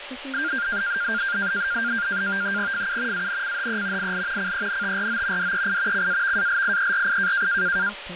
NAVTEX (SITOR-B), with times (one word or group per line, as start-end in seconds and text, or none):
2.7-3.3 FU
3.1-4.1 ANCHE
4.0-4.5 IL
4.4-5.5 CENTRO
5.4-6.1 DEI
5.9-7.5 CAVALIERI